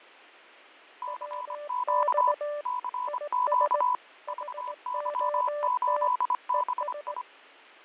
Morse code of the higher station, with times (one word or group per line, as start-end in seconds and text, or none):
1.0-2.3 CQ
2.7-3.9 CQ
4.3-7.2 VY8BI